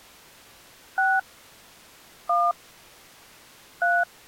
DTMF, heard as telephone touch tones, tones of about 220 ms. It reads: 6 1 3